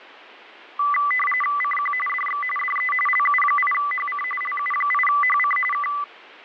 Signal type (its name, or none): RTTY